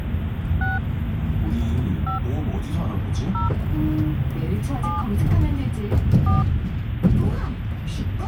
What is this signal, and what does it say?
DTMF, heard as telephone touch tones, dialled by hand, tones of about 150 ms, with phone line noise and the noise inside a bus. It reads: 6 5 0 7 4